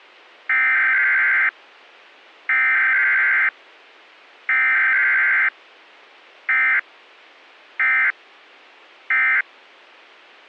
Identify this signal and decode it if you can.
Emergency Alert System (SAME) tones (header bursts, then end-of-message bursts), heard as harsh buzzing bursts, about 520.83 baud.